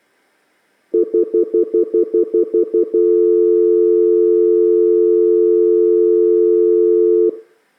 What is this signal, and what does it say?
Telephone call progress tone (North American plan), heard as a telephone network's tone, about 350, 440 Hz, 0.1 s on and 0.1 s off, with room echo. Stutter dial tone.